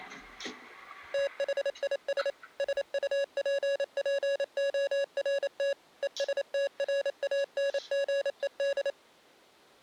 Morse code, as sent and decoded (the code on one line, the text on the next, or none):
- .... .. ... / ... ..- .--. .--. --- .-. - / . ... - .-. .- -. --. . -..
THIS SUPPORT ESTRANGED